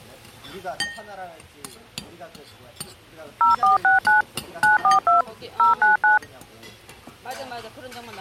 DTMF, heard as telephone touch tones, dialled by machine, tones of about 140 ms, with the noise of a restaurant. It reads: 0469 942 099